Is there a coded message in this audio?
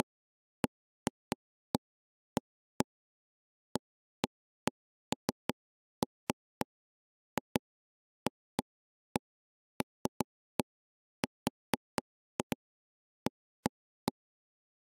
No, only irregular taps on a table.